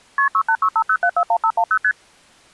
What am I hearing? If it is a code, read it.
Multi-frequency trunk signalling (R1, as on North American trunks), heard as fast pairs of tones, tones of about 70 ms. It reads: KP 68650741510 ST